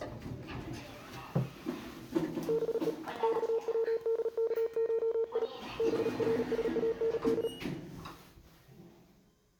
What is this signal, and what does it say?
Morse code (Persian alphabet), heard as a keyed tone, hand-sent with a paddle, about 37 wpm, 450 Hz, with room echo and the noise inside a lift. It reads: به خودکشی برساند